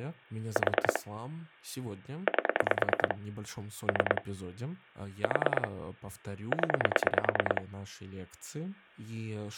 Pulse dialling, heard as clicks on a phone line, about 9 pulses a second, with speech in Russian. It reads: 4 8 3 4 0